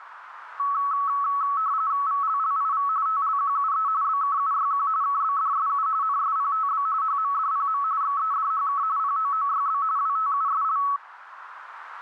RTTY (45.45 baud, 170 Hz shift), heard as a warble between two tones, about 1210 Hz centre, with radio static. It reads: VLLIV TLQUE BKUYQ KBDSU NSPTB HMDPM XEDHK POOYB WTUSL